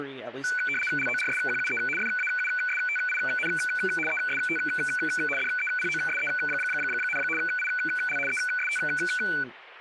RTTY (75 baud, 850 Hz shift), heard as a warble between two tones, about 1900 Hz centre, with radio static and speech in English. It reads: LORSQUE FAUSTIN EST DEPOSE, IL EST